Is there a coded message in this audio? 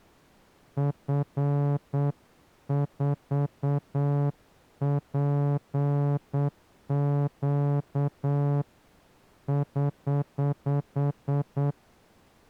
Yes: Morse code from 0.7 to 11.8 s, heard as a horn, hand-sent with a straight key, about 8 wpm. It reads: F4PQ <HH>